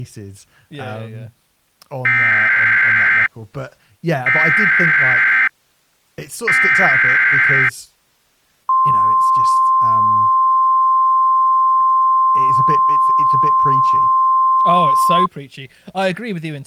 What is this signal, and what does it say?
Emergency Alert System (SAME) tones (header bursts, then the 1050 Hz attention tone), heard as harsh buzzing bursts, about 520.83 baud, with speech in English.